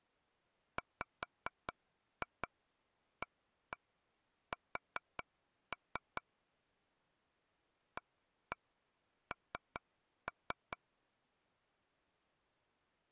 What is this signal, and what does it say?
Tap code, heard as taps on a table, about 4 knocks a second. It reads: WAS AN